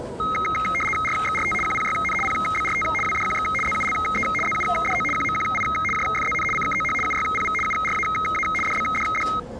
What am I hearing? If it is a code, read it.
RTTY (75 baud, 850 Hz shift), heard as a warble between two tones, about 1700 Hz centre, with the noise of a crowd indoors. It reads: RXRT QPYN PBRT WDQX ZULE ZUDO QMQI JFZN CKOH UYPV URAA DBDD